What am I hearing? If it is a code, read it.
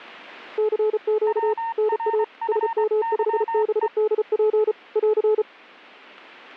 Morse code, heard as two keyed tones. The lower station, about 34 wpm, 430 Hz: CQ NA SM5BDP <AR>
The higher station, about 23 wpm, 910 Hz: WRFYE